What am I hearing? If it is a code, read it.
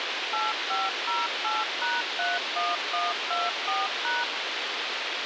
DTMF, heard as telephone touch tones, dialled by machine, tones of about 190 ms, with radio hiss and a squelch burst at the end. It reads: 8508#31124#